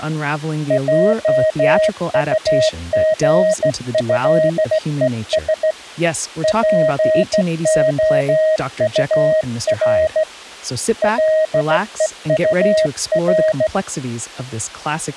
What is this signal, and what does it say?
Morse code (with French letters), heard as a keyed tone, hand-sent with a straight key, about 15 wpm, 630 Hz. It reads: JUGÉES POUR LEUR